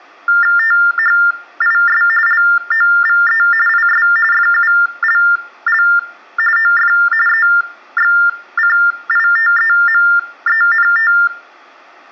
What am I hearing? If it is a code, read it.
TTY/TDD text telephone tones (45.45 baud Baudot), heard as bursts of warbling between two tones, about 400 Hz shift, 1600 Hz centre, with room echo. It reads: THIS LOVE IS FULL OF EXCITEMENT